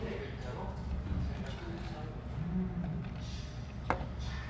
The noise of a restaurant. There is no code.